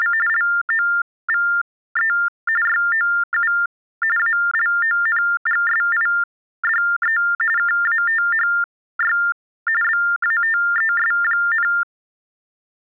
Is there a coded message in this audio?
Yes: TTY/TDD text telephone tones (45.45 baud Baudot) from 0.0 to 11.8 s, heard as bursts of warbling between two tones, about 400 Hz shift, 1600 Hz centre. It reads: … LOVE YOU ALONGSIDE KATHY BATES,